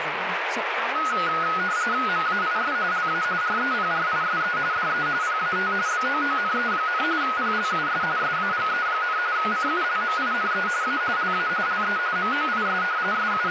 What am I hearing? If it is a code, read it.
RTTY (45.45 baud, 170 Hz shift), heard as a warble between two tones, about 1360 Hz centre, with radio static and speech in English. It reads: MAIS LA REPRISE DE PAT BOONE, PLUS SAGE, CULMINE A LA LE MOIS …